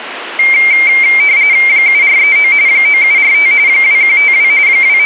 RTTY (45.45 baud, 170 Hz shift), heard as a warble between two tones, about 2200 Hz centre, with radio static. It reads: 7439 9745 2152 …